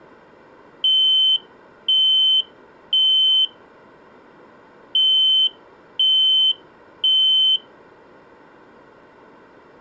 Alarm pattern, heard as an alarm's beeps, played twice, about 3050 Hz. Temporal three. Smoke or fire, evacuate.